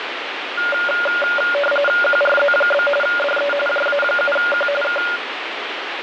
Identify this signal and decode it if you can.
RTTY (45.45 baud, 850 Hz shift), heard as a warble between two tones, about 1000 Hz centre, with radio static. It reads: QRZ? DE JA7Q K